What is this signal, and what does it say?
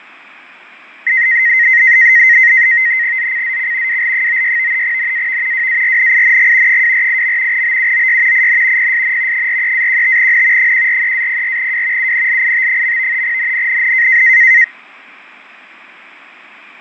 NAVTEX (SITOR-B), 100 baud, 170 Hz shift, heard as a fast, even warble, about 1950 Hz centre, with fading. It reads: ZCZC WL96 NAV WARNING 248. BUOY IN PSN 43-15N 143-04W UNLIT. NNNN